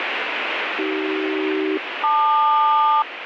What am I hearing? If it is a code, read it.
Aircraft SELCAL, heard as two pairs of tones, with radio static. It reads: AC-LQ